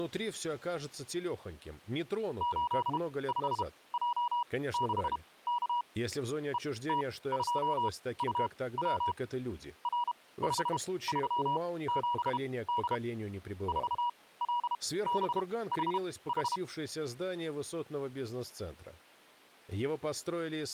Morse code, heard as a keyed tone, machine-sent, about 32 wpm, spaced as for 19 wpm, 960 Hz. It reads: 85J6K ET2UW R537D 4LBHH